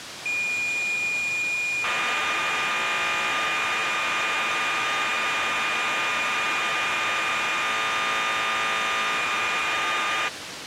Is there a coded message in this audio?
Yes: cassette data (Kansas City type), 1200 baud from 0.3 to 10.3 s, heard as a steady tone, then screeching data, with tape hiss.